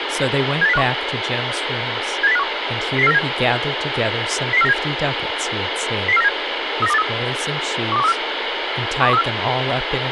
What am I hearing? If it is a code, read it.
Five-tone selective call (EEA), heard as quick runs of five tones, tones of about 40 ms, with radio hiss and speech in English. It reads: 78051 78051 00497 00497 00497 39283 12134 12134